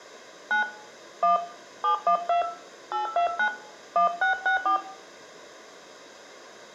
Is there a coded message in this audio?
Yes: DTMF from 0.5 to 4.8 s, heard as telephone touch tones, dialled by hand, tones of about 110 ms, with room echo. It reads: 9 1 712 829 1664